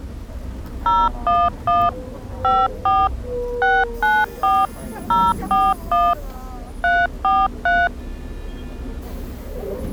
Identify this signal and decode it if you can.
DTMF, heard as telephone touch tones, dialled by machine, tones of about 220 ms, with the noise inside a bus. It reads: 011 54 694 041 343